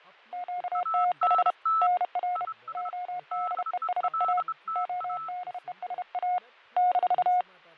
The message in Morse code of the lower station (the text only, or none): QTH NR ODESA ODESA -